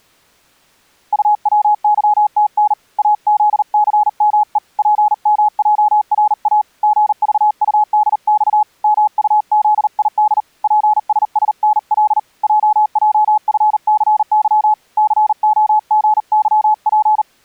Morse code, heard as a keyed tone, hand-sent with a paddle, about 39 wpm, 850 Hz. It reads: UWYTN AZCME PMJRA GVUDX MUZID PSSNL JJFCY COGYP